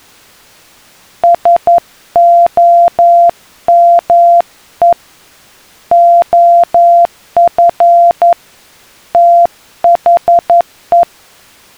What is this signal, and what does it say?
Morse code, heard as a keyed tone, hand-sent with a paddle, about 11 wpm, 690 Hz. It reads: SOME OF THE